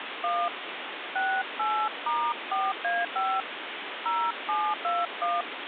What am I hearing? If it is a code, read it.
DTMF, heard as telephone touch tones, dialled by hand, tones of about 230 ms, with phone line noise. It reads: 1 68*4A5 0721